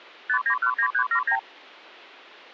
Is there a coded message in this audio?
Yes: multi-frequency trunk signalling (R2, with the far end's replies) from 0.3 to 1.4 s, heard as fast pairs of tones, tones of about 80 ms. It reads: 5919379